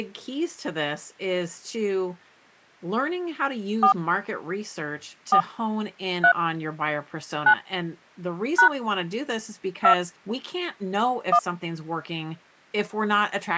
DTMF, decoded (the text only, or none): 4 4 3 9 # 2 1